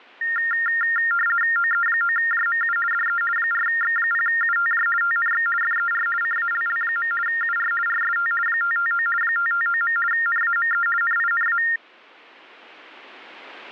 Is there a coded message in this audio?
Yes: RTTY (50 baud, 450 Hz shift) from 0.2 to 11.8 s, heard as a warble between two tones, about 1600 Hz centre. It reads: OE9JMU DE 4X0UTJ TNX FER CALL. UR RST 559 559. NAME NINA